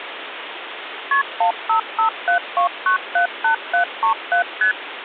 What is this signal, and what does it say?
Multi-frequency trunk signalling (R1, as on North American trunks), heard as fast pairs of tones, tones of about 110 ms, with phone line noise. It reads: KP 15572978737 ST